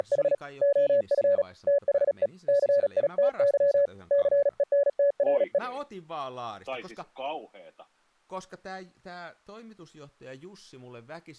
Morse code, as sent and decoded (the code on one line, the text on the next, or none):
… / --- ..-. / - .... . / -.-. .. - -.-- / -.-. . -. - .-. .
… OF THE CITY CENTRE